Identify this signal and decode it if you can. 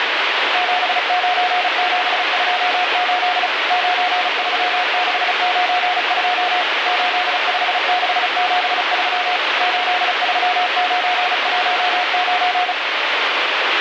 Morse code, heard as a keyed tone, machine-sent, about 35 wpm, 720 Hz, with heavy radio static. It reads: 79728 93692 85673 83919